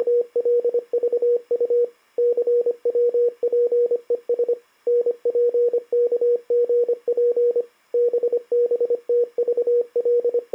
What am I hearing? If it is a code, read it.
Morse code, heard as a keyed tone, machine-sent, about 25 wpm, 480 Hz. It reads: … CWPES NPKGP …